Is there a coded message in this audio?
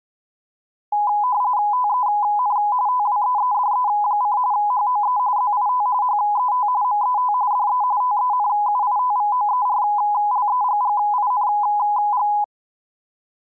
Yes: RTTY (45.45 baud, 170 Hz shift) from 0.9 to 12.4 s, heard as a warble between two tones, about 920 Hz centre. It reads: TEN TWEEDE: HOE ZIT HET MET DE TENUITVOERLEGGING